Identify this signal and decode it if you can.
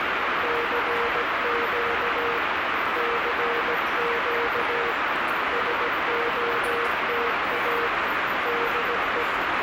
Morse code, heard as a keyed tone, hand-sent with a paddle, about 17 wpm, 470 Hz, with heavy radio static and the noise of a subway station. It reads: CQ CQ SOTA DE